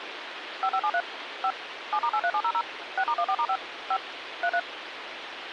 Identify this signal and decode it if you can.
DTMF, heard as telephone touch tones, dialled by machine, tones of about 60 ms, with radio hiss. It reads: 5573 5 7*83700 6*14*5 5 33